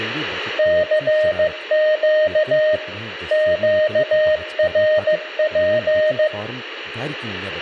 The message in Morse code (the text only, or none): CQ QRP